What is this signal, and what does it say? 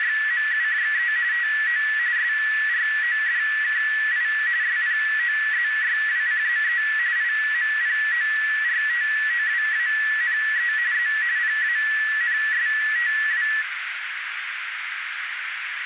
RTTY (45.45 baud, 170 Hz shift), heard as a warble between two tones, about 1850 Hz centre, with radio static and a narrow filter. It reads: … TO SRODKI SPOZYWCZE IMPORTOWANE Z PANSTW